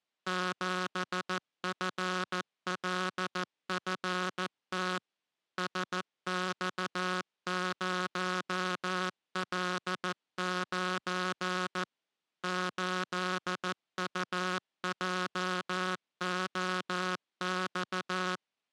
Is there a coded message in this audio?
Yes: Morse code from 0.2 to 18.4 s, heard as a buzzer, machine-sent, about 14 wpm. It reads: 7FLFT SX0L9 8UJOX